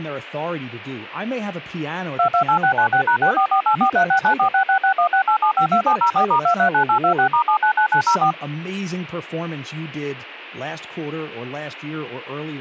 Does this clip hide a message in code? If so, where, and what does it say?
Yes: DTMF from 2.2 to 8.3 s, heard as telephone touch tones, dialled by machine, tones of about 90 ms, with speech in English. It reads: 228696#644843694666168752704*239826*799904